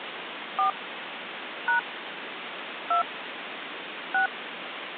DTMF, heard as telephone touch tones, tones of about 120 ms, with phone line noise. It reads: 4 # 2 6